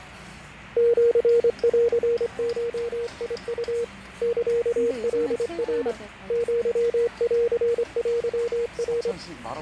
Morse code (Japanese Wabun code), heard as a keyed tone, hand-sent with a straight key, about 25 wpm, 470 Hz, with fading and the noise of a restaurant. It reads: シンゴウ サカナ アンテナ